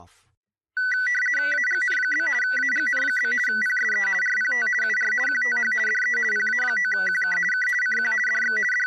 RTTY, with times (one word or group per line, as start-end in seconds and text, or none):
1.5-2.3 AGN?
2.4-3.3 AGN?
3.5-4.1 PSE
4.2-4.7 RPT
4.8-5.1 UR
5.3-5.7 QTH
5.9-6.2 DE
6.3-7.4 PA9QK
7.5-7.7 K
7.8-8.1 CQ
8.3-8.6 DX
8.7-8.9 …